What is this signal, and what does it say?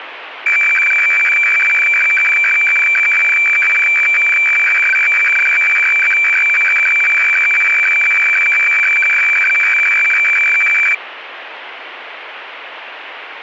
Weather fax (radiofax), 120 lines a minute, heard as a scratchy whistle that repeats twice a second, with radio static.